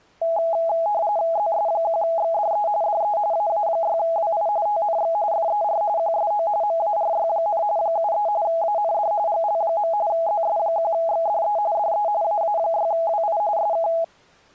RTTY (45.45 baud, 170 Hz shift), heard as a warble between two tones, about 750 Hz centre. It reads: ZS1XDE DE AA6WI TNX FER QSO MARY, 73 AND GL. ZS1XDE DE AA6WI SK